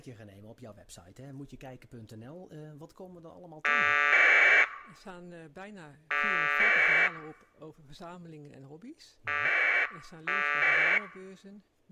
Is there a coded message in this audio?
Yes: packet radio (AX.25, as in APRS), 1200 baud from 3.6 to 11.0 s, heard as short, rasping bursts.